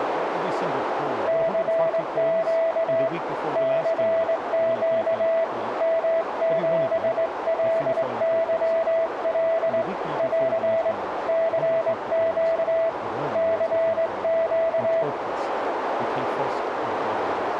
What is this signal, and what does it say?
Morse code, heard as a keyed tone, hand-sent with a straight key, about 21 wpm, 660 Hz, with radio static and a narrow filter. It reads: CQ CQ M7LYL <AR> CQ CQ